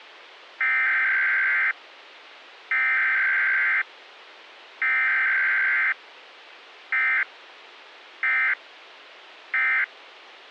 Emergency Alert System (SAME) tones (header bursts, then end-of-message bursts), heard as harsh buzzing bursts, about 520.83 baud.